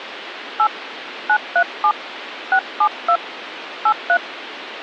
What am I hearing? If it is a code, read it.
DTMF, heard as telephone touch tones, dialled by hand, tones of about 70 ms, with phone line noise. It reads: 8 937 672 83